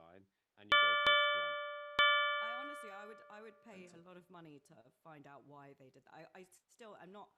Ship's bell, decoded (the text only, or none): 3